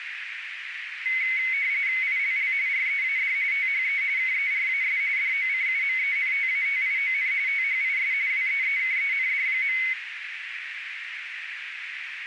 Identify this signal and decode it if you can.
RTTY (45.45 baud, 170 Hz shift), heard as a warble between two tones, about 2150 Hz centre, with radio static and a narrow filter. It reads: ILL READ THE KERAS DOCUMENTATION THIS WEEKEND.